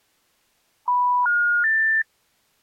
Telephone call progress tone (North American plan), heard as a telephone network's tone, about 980, 1430, 1800 Hz. Special information tone.